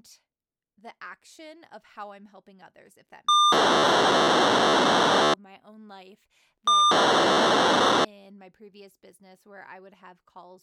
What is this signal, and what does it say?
POCSAG pager data (2400 baud), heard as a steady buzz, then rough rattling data, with speech in English.